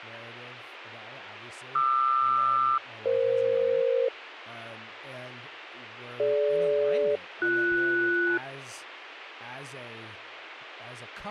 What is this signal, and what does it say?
Aircraft SELCAL, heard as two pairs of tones, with radio hiss and speech in English. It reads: QR-EF DG-BS